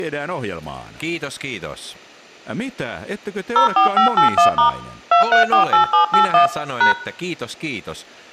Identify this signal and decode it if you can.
DTMF, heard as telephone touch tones, dialled by machine, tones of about 120 ms, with room echo and speech in Finnish. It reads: 04581* 2348781 #